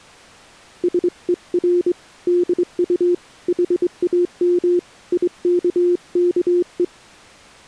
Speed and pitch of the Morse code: 23 wpm, 350 Hz

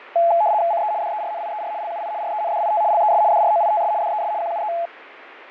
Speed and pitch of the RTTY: 75 baud, 170 Hz shift, 760 Hz centre

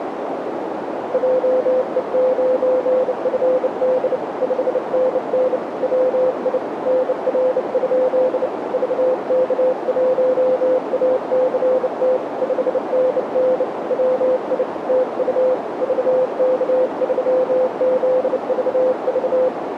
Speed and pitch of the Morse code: 29 wpm, 510 Hz

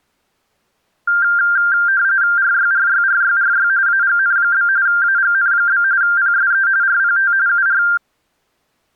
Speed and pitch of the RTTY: 45.45 baud, 170 Hz shift, 1490 Hz centre

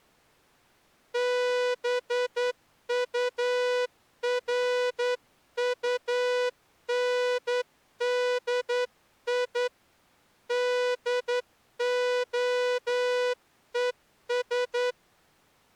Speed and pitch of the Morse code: 10 wpm

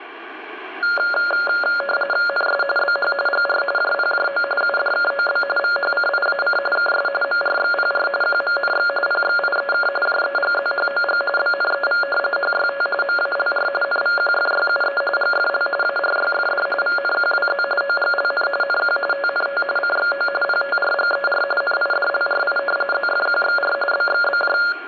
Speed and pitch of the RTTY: 45.45 baud, 850 Hz shift, 980 Hz centre

